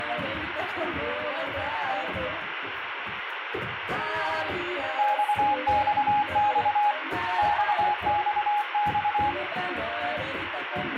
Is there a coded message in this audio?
Yes: Morse code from 4.9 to 9.4 s, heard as a keyed tone, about 24 wpm, 830 Hz, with radio static. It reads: XXX XXX